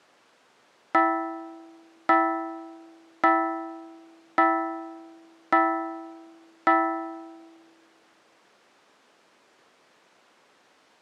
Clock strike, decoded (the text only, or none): 6